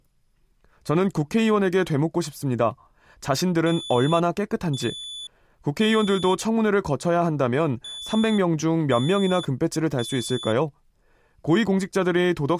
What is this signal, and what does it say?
Alarm pattern, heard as an alarm's beeps, played twice, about 3450 Hz, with speech in Korean. Temporal three. Smoke or fire, evacuate.